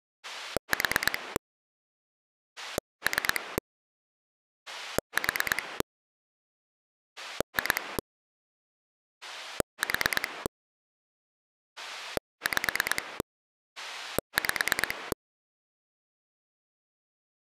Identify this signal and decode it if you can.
Pulse dialling, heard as a rotary dial, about 9 pulses a second. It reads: 4 3 4 2 4 5 5